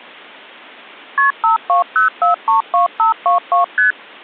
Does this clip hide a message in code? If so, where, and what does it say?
Yes: multi-frequency trunk signalling (R1, as on North American trunks) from 1.2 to 3.9 s, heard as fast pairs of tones, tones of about 130 ms. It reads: KP 520432522 ST